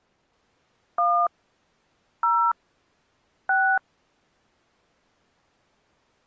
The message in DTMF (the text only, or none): 1 0 6